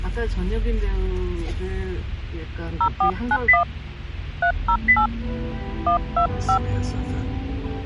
DTMF, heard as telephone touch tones, dialled by hand, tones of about 90 ms, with the noise inside a car. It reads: 0491 308 125